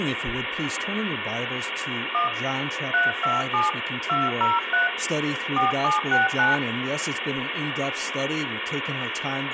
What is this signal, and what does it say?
DTMF, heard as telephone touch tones, dialled by hand, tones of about 160 ms, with phone line noise. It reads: 1 327 203 4769